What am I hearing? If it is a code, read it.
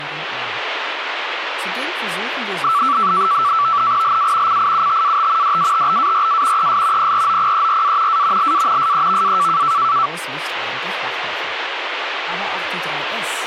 NAVTEX (SITOR-B), 100 baud, 170 Hz shift, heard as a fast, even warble, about 1240 Hz centre, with radio static. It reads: LA CIUTAT DATBARA ES PROPERA A LA SEVA